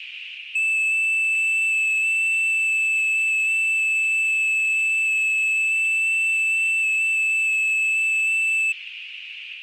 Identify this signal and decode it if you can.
FT8 (one signal), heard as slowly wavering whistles, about 6.25 baud, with radio static and a narrow filter.